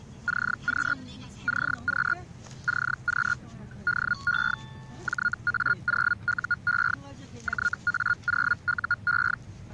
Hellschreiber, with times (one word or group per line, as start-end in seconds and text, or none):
0.3-0.9 CQ
1.5-2.1 CQ
2.7-3.3 CQ
3.9-4.5 DE
5.1-6.9 JA0UE
7.5-9.3 JA0UE